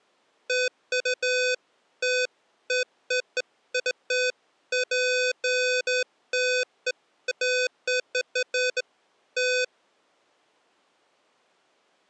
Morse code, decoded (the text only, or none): none